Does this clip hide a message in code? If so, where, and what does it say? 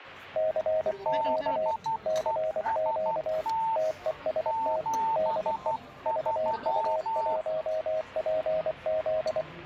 Yes: Morse code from 0.3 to 9.5 s, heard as two keyed tones, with the noise of a crowd indoors. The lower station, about 24 wpm, 630 Hz: CQ CQ TEST DE VU1PZ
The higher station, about 12 wpm, 900 Hz: BEST 73